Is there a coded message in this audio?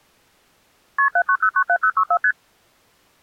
Yes: multi-frequency trunk signalling (R1, as on North American trunks) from 1.0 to 2.3 s, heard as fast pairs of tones, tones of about 70 ms. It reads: KP 79097064 ST